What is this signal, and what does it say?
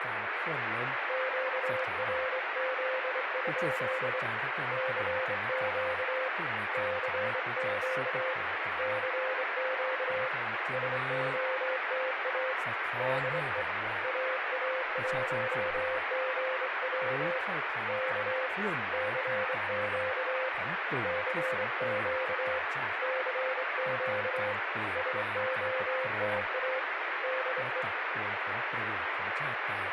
Morse code, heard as a keyed tone, hand-sent with a straight key, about 24 wpm, 520 Hz, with radio static and speech in Thai. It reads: QRZ? CQ CQ CQ SOTA DE AA1GW K CQ CQ CQ SOTA DE